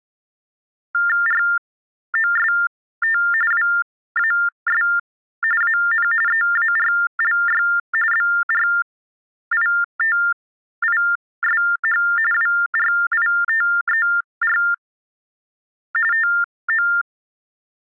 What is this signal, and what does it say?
TTY/TDD text telephone tones (45.45 baud Baudot), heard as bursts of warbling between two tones, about 400 Hz shift, 1600 Hz centre. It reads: ROST WAS AN EARLY BRITISH WRITER TO